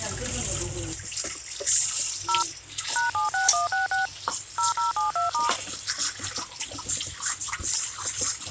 DTMF, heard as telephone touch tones, dialled by machine, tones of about 140 ms, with hum and kitchen noise. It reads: 0 #76166 0072*